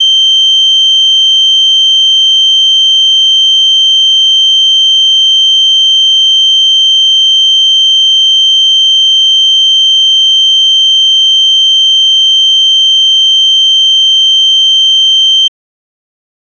A steady tone. There is no code.